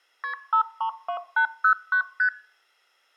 Multi-frequency trunk signalling (R1, as on North American trunks), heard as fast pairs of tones, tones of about 90 ms. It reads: KP 532809 ST